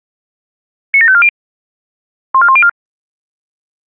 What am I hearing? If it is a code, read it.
Five-tone selective call (ZVEI), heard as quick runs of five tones, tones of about 70 ms. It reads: 97540 14104